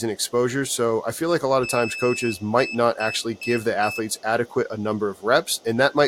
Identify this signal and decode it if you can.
Beep code, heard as a piezo beeper, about 2600 Hz, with room echo and speech in English. 1 long, 4 short.